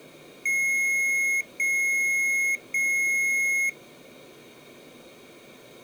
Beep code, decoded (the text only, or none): 3 long